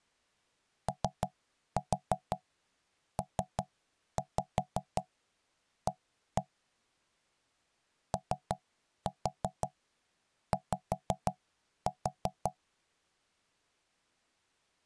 Tap code, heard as knocks on wood, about 5 knocks a second. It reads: OPA OY